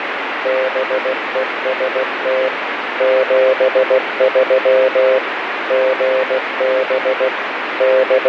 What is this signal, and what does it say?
Morse code, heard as a keyed tone, machine-sent, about 16 wpm, 520 Hz, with radio static. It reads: BEST 73 GB …